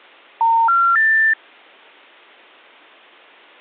Telephone call progress tone (North American plan), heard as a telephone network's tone, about 910, 1370, 1800 Hz. Special information tone.